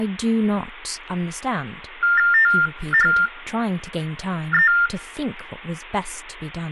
TTY/TDD text telephone tones (45.45 baud Baudot), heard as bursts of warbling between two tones, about 400 Hz shift, 1600 Hz centre, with speech in English. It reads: THE